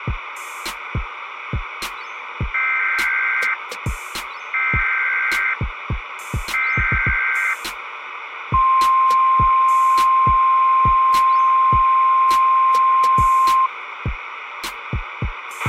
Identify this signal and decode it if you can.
Emergency Alert System (SAME) tones (header bursts, then the 1050 Hz attention tone), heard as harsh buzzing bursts, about 520.83 baud, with radio hiss and a squelch burst at the end.